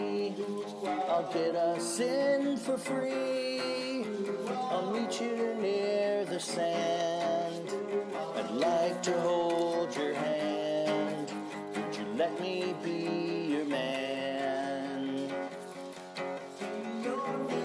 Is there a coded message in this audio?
No.